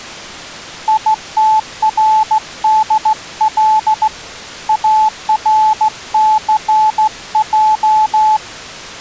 Morse code, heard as a keyed tone, hand-sent with a straight key, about 15 wpm, 870 Hz. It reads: ITRDL ARCJ